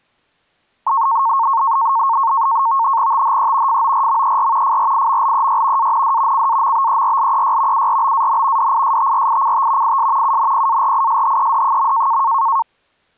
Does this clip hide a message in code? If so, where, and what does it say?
Yes: NAVTEX (SITOR-B), 100 baud, 170 Hz shift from 0.9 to 12.6 s, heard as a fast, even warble, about 1000 Hz centre. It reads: THE FORMER FRIMLEY AND CAMBERLEY URBAN DISTRICT IS UNPARISHED.